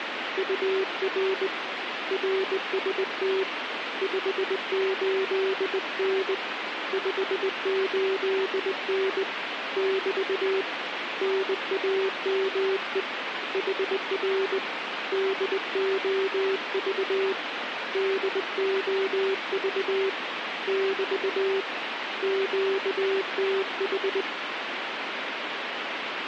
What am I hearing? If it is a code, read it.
Morse code, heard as a keyed tone, hand-sent with a straight key, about 20 wpm, 390 Hz, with radio static. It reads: UR RST 58N 58N <BT> NAME HR DOV DOV <BT> QTH